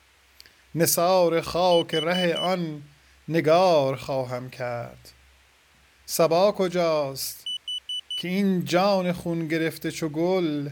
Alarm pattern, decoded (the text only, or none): temporal four